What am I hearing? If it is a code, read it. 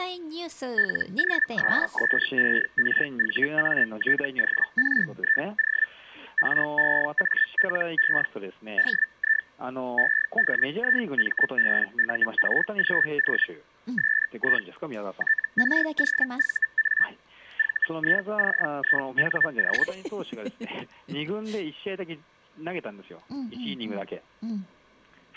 Hellschreiber (Feld-Hell, 122.5 baud), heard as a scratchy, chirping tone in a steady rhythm, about 1750 Hz. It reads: LOSSERVATORIO REALE DI EDIMBURGO SI TROVA VICINO